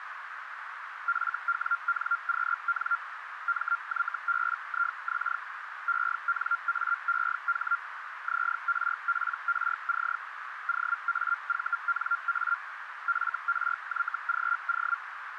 Hellschreiber (Feld-Hell, 122.5 baud), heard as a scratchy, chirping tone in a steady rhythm, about 1390 Hz, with radio static and a narrow filter. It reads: FWNQN MYBIX ENAEH ZRPRC OAVNA FRYGO